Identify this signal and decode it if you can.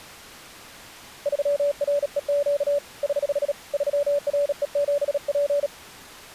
Morse code, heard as a keyed tone, hand-sent with a bug key, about 37 wpm, 570 Hz. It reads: 3REQ <HH> 3RE7P